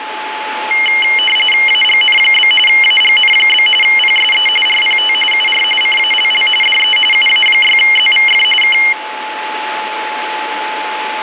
RTTY (45.45 baud, 850 Hz shift), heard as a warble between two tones, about 2550 Hz centre, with radio static and a steady whistle near 860 Hz. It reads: AGN? AGN? PSE RPT UR CALL DE UA6ZVF K